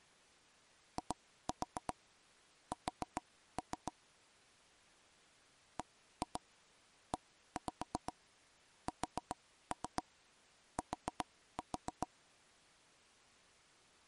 Tap code, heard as taps on a table, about 7 knocks a second. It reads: IS BEST